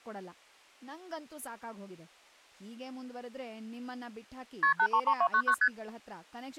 Multi-frequency trunk signalling (R1, as on North American trunks), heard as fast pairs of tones, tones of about 70 ms, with speech in Kannada. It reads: KP 833299 ST